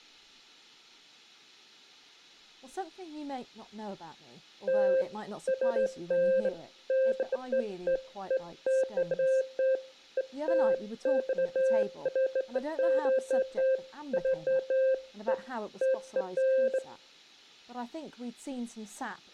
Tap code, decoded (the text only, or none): none